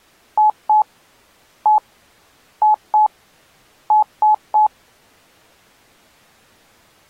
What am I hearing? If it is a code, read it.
Beep code, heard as beeps, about 850 Hz. 2-1-2-3. In Phoenix BIOS tables: ROM copyright notice check failure.